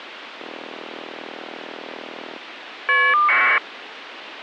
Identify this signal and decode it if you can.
Caller ID data burst, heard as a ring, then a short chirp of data, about 1200 baud, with phone line noise.